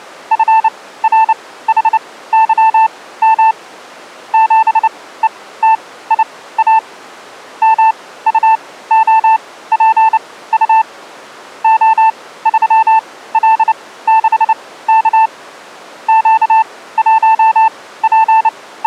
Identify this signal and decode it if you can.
Morse code, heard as a keyed tone, machine-sent, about 29 wpm, spaced as for 17 wpm, 890 Hz. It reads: FRHYM 7ETIA MUOPU O3L6K …